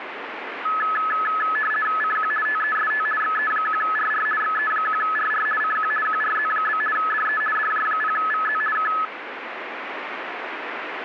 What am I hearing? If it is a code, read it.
RTTY (50 baud, 450 Hz shift), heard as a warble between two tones, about 1500 Hz centre, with radio static. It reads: CQ TEST XE1RR XE1RR CQ QRZ? DE DJ0VZ K